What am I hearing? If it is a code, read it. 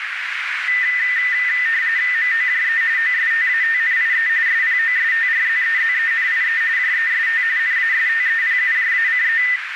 RTTY (45.45 baud, 170 Hz shift), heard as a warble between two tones, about 1900 Hz centre, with radio static and a narrow filter. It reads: MOJE OSTATNIE SPOSTRZEZENIE JEST NASTEPUJACE